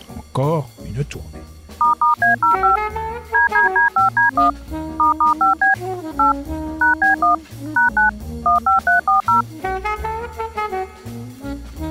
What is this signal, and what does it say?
DTMF, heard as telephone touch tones, dialled by machine, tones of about 130 ms. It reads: **A05 DDD5D1 **5B 8 #B1 #9 15340